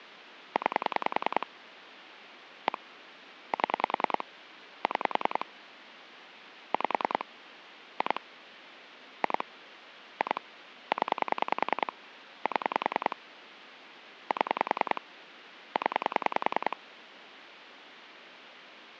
Pulse dialling, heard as clicks on a phone line, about 10 pulses a second, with phone line noise. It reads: 9 1 7 6 5 2 2 2 0 7 7 0